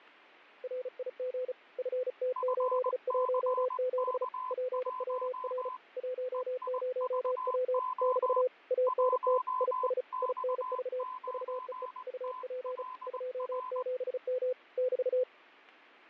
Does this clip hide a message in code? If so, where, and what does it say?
Yes: Morse code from 0.6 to 15.3 s, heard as two keyed tones, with fading and static crashes. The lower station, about 35 wpm, 510 Hz: RIG FT817 PWR 10W <BT> ANT IS INV VEE UP 27M <BT>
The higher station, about 20 wpm, 1020 Hz: FCK1 EIVO 1X9TLR